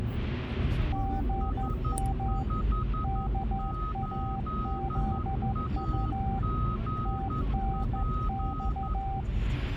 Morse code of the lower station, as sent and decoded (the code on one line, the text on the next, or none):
--. -- / -.- .- --.. ..- / - -. -..-
GM KAZU TNX